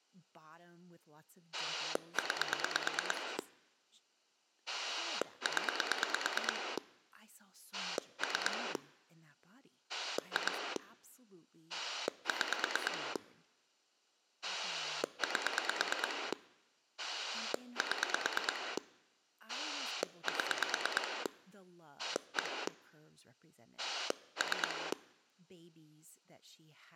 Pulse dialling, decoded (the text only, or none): 9 0 3 2 6 8 7 7 1 3